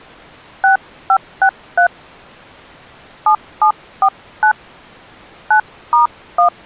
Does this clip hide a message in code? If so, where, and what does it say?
Yes: DTMF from 0.6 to 6.5 s, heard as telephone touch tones, dialled by hand, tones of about 100 ms. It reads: 6563 7749 9*1